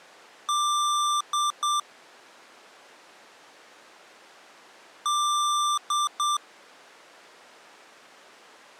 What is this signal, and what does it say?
Beep code, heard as beeps from a small speaker, played twice, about 1180 Hz. 1 long, 2 short. In Award, IBM and AMI BIOS tables: video adapter failure.